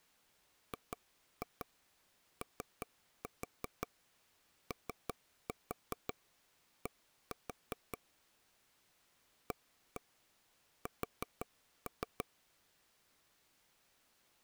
Tap code, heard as taps on a table, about 5 knocks a second. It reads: GOOD AS